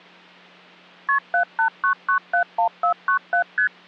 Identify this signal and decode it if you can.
Multi-frequency trunk signalling (R1, as on North American trunks), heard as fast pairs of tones, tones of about 100 ms, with hum. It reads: KP 789971497 ST